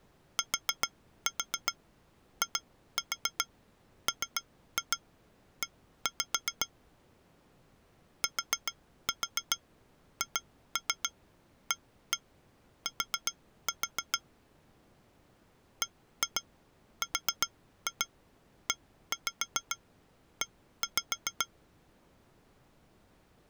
Tap code, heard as taps on glass, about 7 knocks a second. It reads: TIME THAT BREE